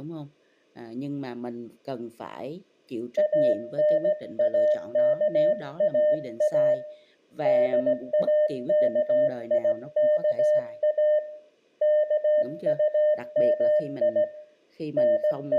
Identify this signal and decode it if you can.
Morse code, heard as a keyed tone, hand-sent with a straight key, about 17 wpm, 600 Hz, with room echo and speech in Vietnamese. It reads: ANAKAA DAKIKA KUMI …